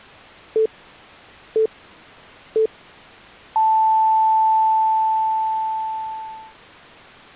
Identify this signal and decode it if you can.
Radio time signal (three low pips and a long one an octave up, as on NHK), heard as pips.